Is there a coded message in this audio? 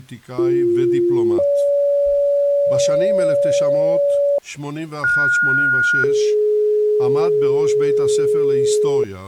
Yes: two-tone page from 0.4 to 9.0 s, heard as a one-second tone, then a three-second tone, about 350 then 570 Hz, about 1430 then 420 Hz, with speech in Hebrew.